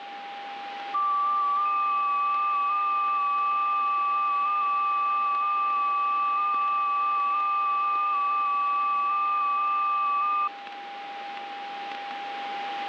FT8 (several signals at once), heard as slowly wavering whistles, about 6.25 baud, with radio static and a steady whistle near 800 Hz.